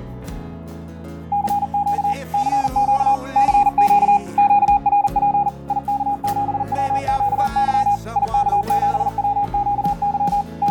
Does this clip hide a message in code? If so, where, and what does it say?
Yes: Morse code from 1.3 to 10.7 s, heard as a keyed tone, machine-sent, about 40 wpm, 820 Hz, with fading and static crashes. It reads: CQ CQ CQ QRP IK7WQY IK7WQY …